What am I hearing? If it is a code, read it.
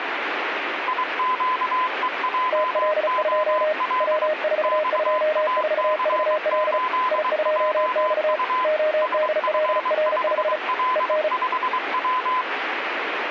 Morse code, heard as two keyed tones, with radio static. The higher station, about 23 wpm, 1020 Hz: IQEJOL XAC8JU SF5L5W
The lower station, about 35 wpm, 620 Hz: TL2 W424VL I2X ODLR5 EN